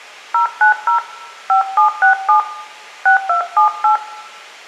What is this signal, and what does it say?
DTMF, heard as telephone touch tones, dialled by hand, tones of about 110 ms, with room echo. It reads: 090 5767 6278